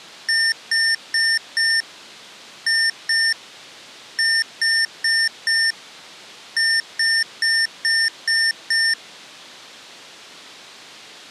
Beep code, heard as beeps from a small speaker, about 1800 Hz. 4-2-4-6.